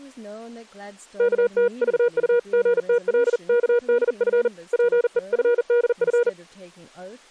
Morse code (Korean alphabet), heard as a keyed tone, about 40 wpm, 480 Hz, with speech in English. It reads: 어리석은 자는